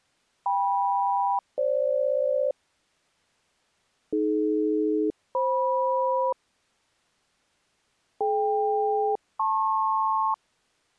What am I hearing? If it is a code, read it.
Aircraft SELCAL, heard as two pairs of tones. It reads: KM-FG AD-FM DK-LP